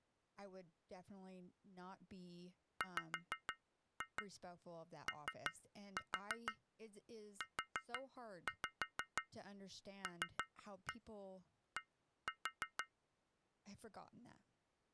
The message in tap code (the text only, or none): WOULD